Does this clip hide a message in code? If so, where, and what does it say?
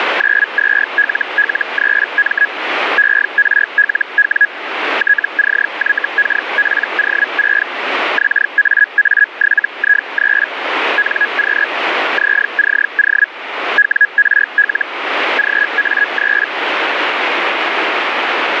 Yes: Hellschreiber (Feld-Hell, 122.5 baud) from 0.2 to 16.5 s, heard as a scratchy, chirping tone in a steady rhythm, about 1650 Hz, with radio static. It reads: 92LL3M ERLW TCYKPO6 XAA7I3 NQ ZCO WRL GA3